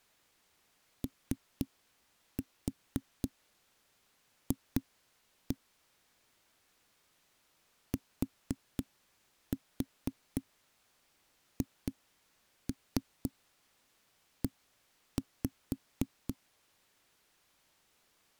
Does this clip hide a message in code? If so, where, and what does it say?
Yes: tap code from 1.0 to 16.4 s, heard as knocks on a wall, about 4 knocks a second. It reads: OF THE